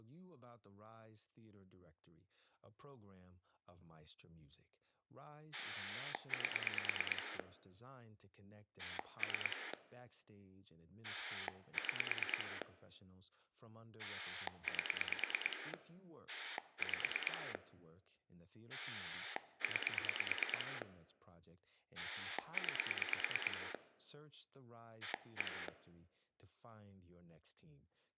Pulse dialling, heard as a rotary dial, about 9 pulses a second, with speech in English. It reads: 8 3 6 8 5 9 9 1